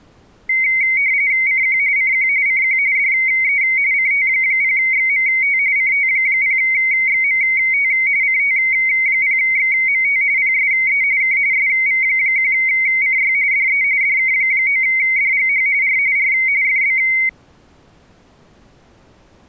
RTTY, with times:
1.5-1.8 CQ
2.0-2.3 CQ
2.5-2.8 CQ
3.0-3.6 DE
3.9-5.6 CT0XMT
5.8-7.9 CT0XMT
8.2-10.2 CT0XMT
10.4-11.0 PSE
11.2-11.4 K
11.5-13.3 SV1CY
13.5-13.8 DE
14.0-15.7 DK9DGH
15.8-16.0 R
16.2-16.3 R
16.6-17.0 FB

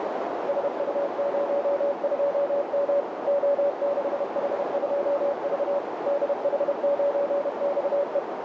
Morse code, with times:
0.5-3.0 SU02M
3.3-5.8 O6H2V
6.1-8.2 DH9XE

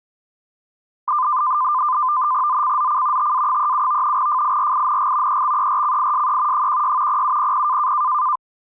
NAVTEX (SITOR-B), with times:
2.5-3.3 ZCZC
3.2-4.2 TA37
4.2-5.4 FIRING
5.3-6.7 EXERCISE
6.5-7.2 16
7.1-7.9 0700

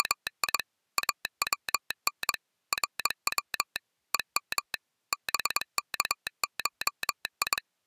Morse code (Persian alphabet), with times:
0.0-0.6 …
1.0-2.3 اون
2.7-3.8 رو
4.1-4.7 هم
5.1-7.6 بکشی

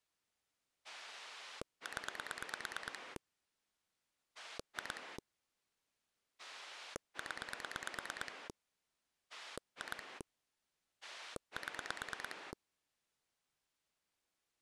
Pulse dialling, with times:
0.8-3.2 0
4.4-5.2 2
6.4-8.5 0
9.3-10.2 2
11.0-12.5 7

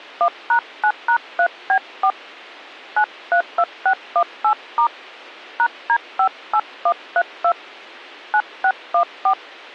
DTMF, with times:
0.2-2.1 1#9#3B4
3.0-4.9 932618*
5.6-7.5 #D58132
8.3-9.3 9614

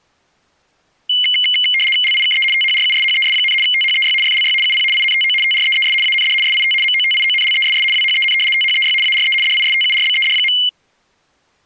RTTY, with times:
2.0-2.4 LIKE
2.5-3.5 THRUSHES,
3.6-4.1 THEY
4.2-4.5 FLY
4.6-4.8 UP
4.9-5.3 INTO
5.4-5.9 TREES
6.0-6.3 AND
6.4-6.7 SIT
6.8-7.8 MOTIONLESS
7.9-8.3 WHEN
8.5-8.9 THEY
9.0-9.3 ARE
9.4-10.5 DISTURBED.

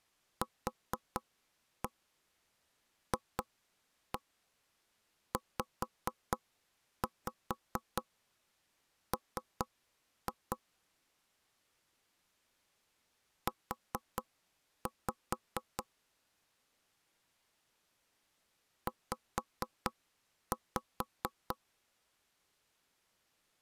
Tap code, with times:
0.4-10.6 QFZM
13.5-15.8 U
18.9-21.6 Z

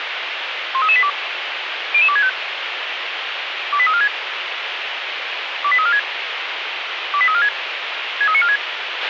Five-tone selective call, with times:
0.7-1.1 13382
1.9-2.3 00265
3.7-4.1 28346
5.6-6.0 28346
7.1-7.5 28346
8.2-8.6 63946

